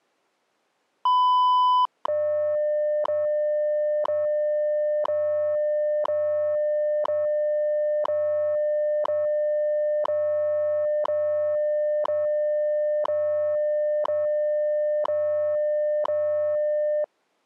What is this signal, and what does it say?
Radio time signal (WWV, Colorado), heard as ticks, one a second.